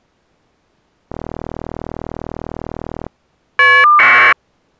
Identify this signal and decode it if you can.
Caller ID data burst, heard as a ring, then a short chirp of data, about 1200 baud.